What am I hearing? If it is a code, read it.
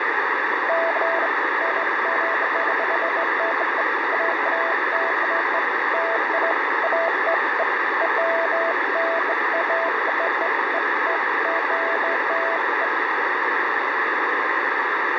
Beeps of irregular length, with radio static. There is no code.